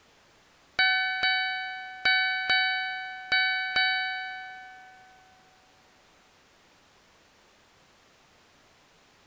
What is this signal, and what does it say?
Ship's bell, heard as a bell. 6. Six half-hours of the watch have passed.